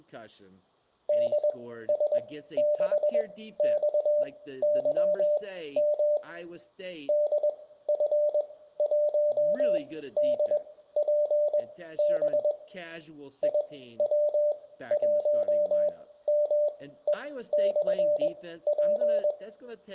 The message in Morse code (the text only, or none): DS6XYM DF1DPB IW1ME/P